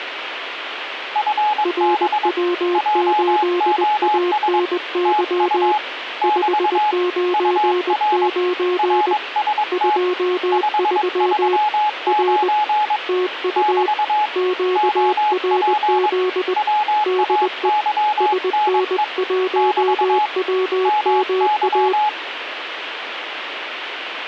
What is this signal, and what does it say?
Morse code, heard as two keyed tones, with radio static. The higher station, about 22 wpm, 840 Hz: FB JOS TU <BT> UR RST 539 <BT> OP WAYNE <BT> MY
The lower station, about 20 wpm, 360 Hz: RW8ANY 599 23 R TU QRZ DE SN1WMA